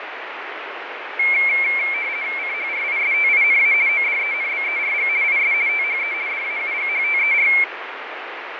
RTTY (50 baud, 170 Hz shift), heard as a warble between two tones, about 2250 Hz centre, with radio static and fading. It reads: CHRISTINA ODENBERG IS THE DAUGHTER